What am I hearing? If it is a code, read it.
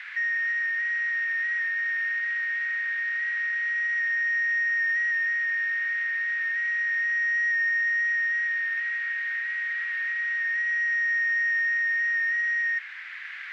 FT8 (one signal), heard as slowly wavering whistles, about 6.25 baud, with radio static and a narrow filter.